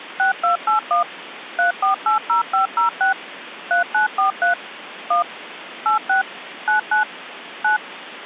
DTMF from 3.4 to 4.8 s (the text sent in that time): 3943